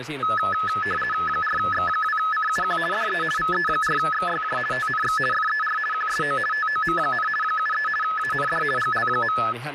RTTY (50 baud, 450 Hz shift), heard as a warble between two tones, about 1500 Hz centre, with radio static and speech in Finnish. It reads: 4X2CUQ DE VE4XYJ TNX FER QSO TOM, 73 AND GL.